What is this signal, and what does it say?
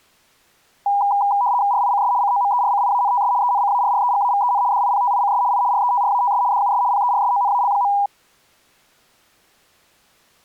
RTTY (75 baud, 170 Hz shift), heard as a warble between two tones, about 890 Hz centre. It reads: RICS COMERCIANTS ENCARREGAVEN DIPTICS I RETRATS DUS PERSONAL.